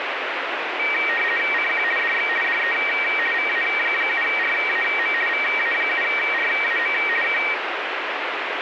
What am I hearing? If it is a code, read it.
RTTY (50 baud, 450 Hz shift), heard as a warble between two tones, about 2100 Hz centre, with radio static. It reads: CQ DX DE VA7RAM VA7RAM K